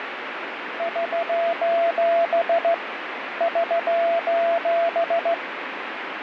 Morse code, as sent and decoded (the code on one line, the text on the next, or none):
...---... / ...---...
<SOS> <SOS>